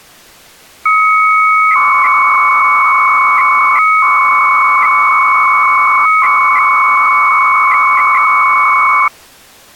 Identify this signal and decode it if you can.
300-baud modem data (Bell 103 tones), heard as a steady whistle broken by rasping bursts, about 300 baud, 200 Hz shift.